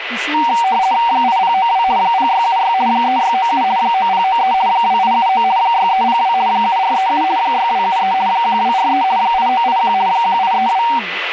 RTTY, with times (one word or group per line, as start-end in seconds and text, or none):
1.1-1.8 8092
2.0-2.7 0676
2.9-3.6 3697
3.8-4.5 9093
4.7-5.4 2879
5.6-6.3 6302
6.5-7.2 7437
7.4-8.1 6273
8.3-9.0 1243
9.2-9.9 8981
10.1-10.8 1832